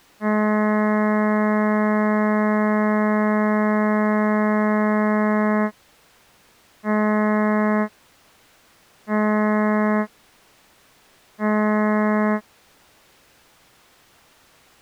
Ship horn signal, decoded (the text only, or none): 1 long, 3 short